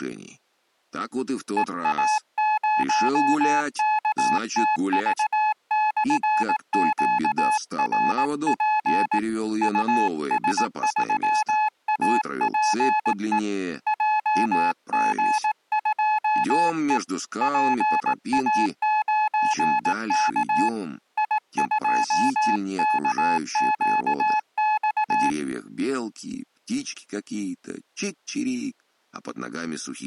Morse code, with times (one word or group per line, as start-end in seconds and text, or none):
1.6-9.2 EA0KTV/QRP
9.6-13.4 US3APE
13.9-17.0 JG2E
17.4-20.7 PA9K
21.2-25.3 I2KQX